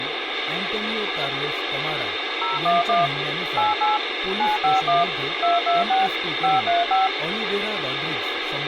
DTMF, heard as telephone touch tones, dialled by machine, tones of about 160 ms, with radio hiss and speech in Marathi. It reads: 011 88 951 226 535